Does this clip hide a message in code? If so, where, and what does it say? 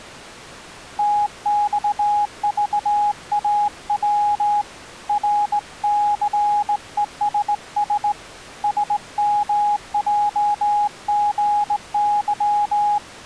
Yes: Morse code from 0.9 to 13.0 s, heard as a keyed tone, hand-sent with a straight key, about 18 wpm, 830 Hz. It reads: TXVAW RCESS SMJGY